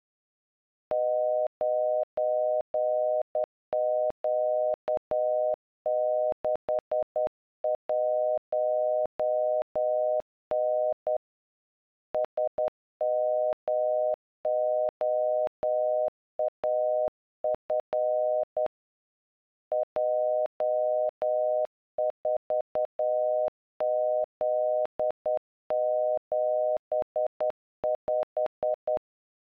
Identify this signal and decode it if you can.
Morse code, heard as a keyed tone, hand-sent with a straight key, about 10 wpm, 620 Hz. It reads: 9Q61N SMOAF J4Z75